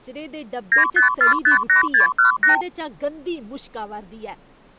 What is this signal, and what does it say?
Multi-frequency trunk signalling (R2, with the far end's replies), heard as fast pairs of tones, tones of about 120 ms, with speech in Dogri. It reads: 95458618